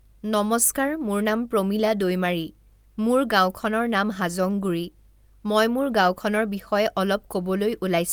Speech in Assamese. There is no code.